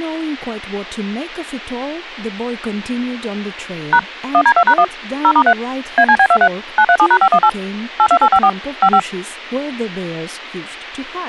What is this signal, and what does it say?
DTMF, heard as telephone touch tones, dialled by machine, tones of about 70 ms, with speech in English. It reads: # 1D2#1 0*3 ACB23 937#518 82854 55